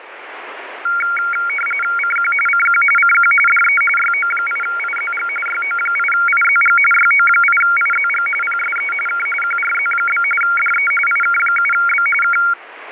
RTTY (45.45 baud, 850 Hz shift), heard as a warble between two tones, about 1800 Hz centre, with radio static. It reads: CQ CQ CQ DE YO8IZG YO8IZG YO8IZG PSE K QRZ? DE IK7B K